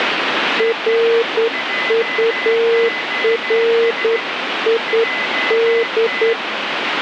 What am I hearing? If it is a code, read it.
Morse code, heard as a keyed tone, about 9 wpm, 460 Hz, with radio static and a weaker station near 2020 Hz. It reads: RURID